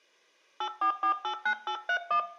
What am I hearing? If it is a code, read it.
DTMF, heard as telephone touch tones, dialled by hand, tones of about 90 ms, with room echo. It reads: 84489831